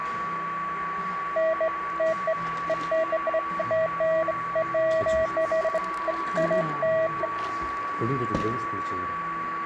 Beeps of irregular length, with a steady whistle near 1140 Hz and the noise of a cafe. There is no code.